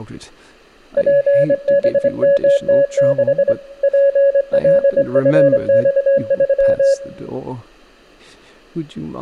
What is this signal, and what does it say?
Morse code, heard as a keyed tone, hand-sent with a straight key, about 24 wpm, 560 Hz, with room echo and speech in English. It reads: PBMT6 PLFX3